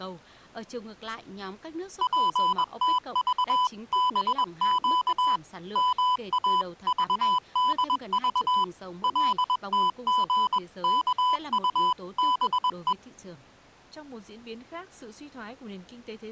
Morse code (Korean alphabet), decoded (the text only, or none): 절대 모를 것이다